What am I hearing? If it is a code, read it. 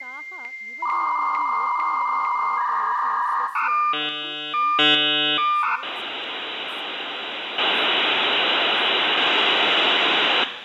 Dial-up modem handshake (V.34 or later), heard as a whistle, warbles, then hiss, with room echo and speech in Sanskrit.